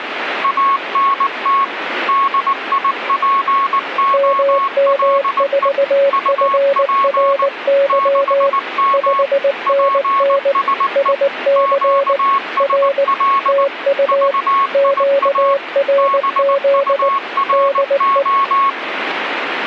Morse code, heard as two keyed tones, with radio static. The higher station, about 19 wpm, 1100 Hz: ANT DIPOLE UP 6M PSE QSL VIA BURO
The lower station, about 19 wpm, 560 Hz: MM4FRY 5NN SC R TU QRZ DE